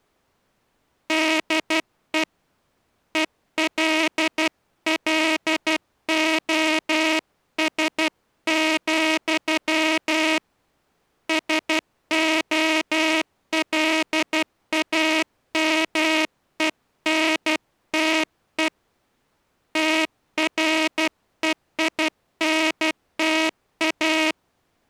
Morse code, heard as a buzzer, hand-sent with a paddle, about 12 wpm. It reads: DE ELLOS, SOLAMENTE TREINTA